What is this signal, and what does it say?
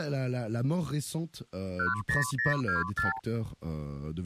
Multi-frequency trunk signalling (R2, with the far end's replies), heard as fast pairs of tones, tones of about 150 ms. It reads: 10024